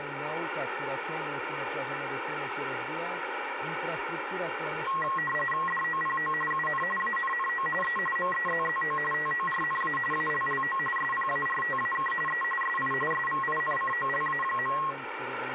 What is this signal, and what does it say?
RTTY (45.45 baud, 850 Hz shift), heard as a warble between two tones, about 1500 Hz centre, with radio static. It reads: DOPO UN ANNO E MEZZO TORNA ALLO SPARTAK E SI SVINCOLA.